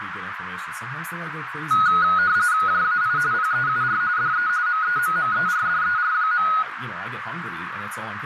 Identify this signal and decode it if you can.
RTTY (45.45 baud, 170 Hz shift), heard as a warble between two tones, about 1360 Hz centre, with radio static, a narrow filter and speech in English. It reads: JAI PEUR DE MEMMERDER.